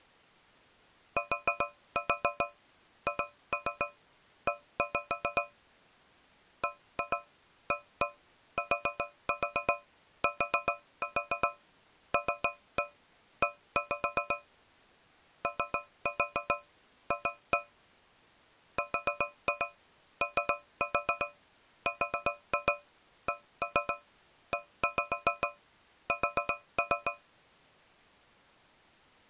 Tap code, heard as taps on a metal pipe, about 7 knocks a second. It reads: THE BATTLE OF RORKES